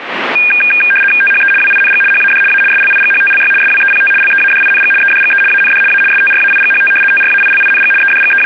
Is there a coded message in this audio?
Yes: RTTY (75 baud, 850 Hz shift) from 0.4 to 8.5 s, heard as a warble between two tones, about 2000 Hz centre, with radio static. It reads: THE WING HAD A SLIGHTLY SWEPT LEADING EDGE AND A STRAIGHT TRAILING …